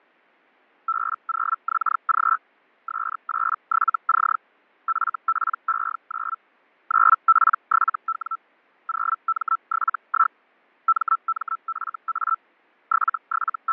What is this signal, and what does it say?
Hellschreiber (Feld-Hell, 122.5 baud), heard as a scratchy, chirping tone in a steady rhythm, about 1330 Hz, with fading. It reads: B0XG S87C FPE9 9P7W 0M71 MMFA …